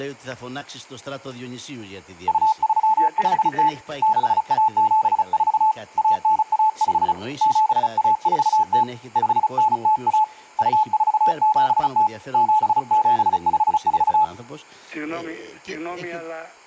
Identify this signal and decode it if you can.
Morse code (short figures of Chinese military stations), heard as a keyed tone, hand-sent with a paddle, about 35 wpm, 870 Hz. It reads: 2350 6174 1915 7140 5901 2470 7754